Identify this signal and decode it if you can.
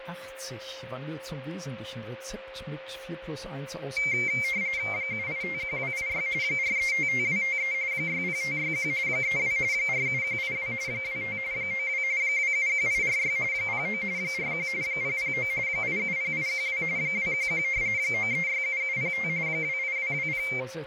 RTTY (45.45 baud, 170 Hz shift), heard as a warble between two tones, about 2200 Hz centre, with radio static, fading and a steady whistle near 530 Hz. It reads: 7851286 4355253 60561 32 47182 25 92 271846 09 41 009 870812 211 9367705 28220